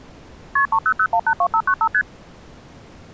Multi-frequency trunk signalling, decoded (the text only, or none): KP 300182595 ST